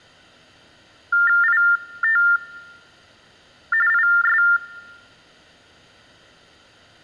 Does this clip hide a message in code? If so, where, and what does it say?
Yes: TTY/TDD text telephone tones (45.45 baud Baudot) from 1.1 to 4.6 s, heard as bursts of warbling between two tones, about 400 Hz shift, 1600 Hz centre. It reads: IT IS